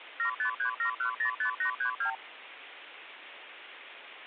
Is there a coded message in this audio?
Yes: multi-frequency trunk signalling (R2, with the far end's replies) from 0.2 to 2.2 s, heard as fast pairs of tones, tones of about 100 ms, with phone line noise. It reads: 7537105832